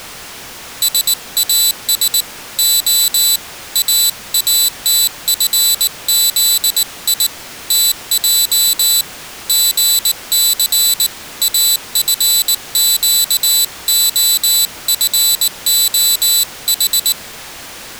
Morse code, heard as a high beeper, hand-sent with a paddle, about 19 wpm, 3950 Hz. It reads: SAS O AATFZI TJ GC AFQOFOH